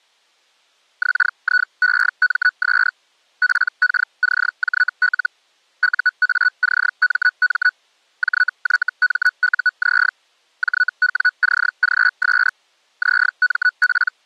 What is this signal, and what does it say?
Hellschreiber (Feld-Hell, 122.5 baud), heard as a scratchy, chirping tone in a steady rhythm, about 1480 Hz. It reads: XIEMS PKCJL UACMM JYMUZ JWCGS …